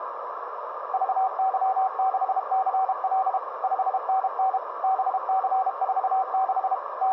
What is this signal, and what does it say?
Morse code, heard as a keyed tone, machine-sent, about 32 wpm, 760 Hz, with radio static, a narrow filter and room echo. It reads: VY6CL 5NN BC46 …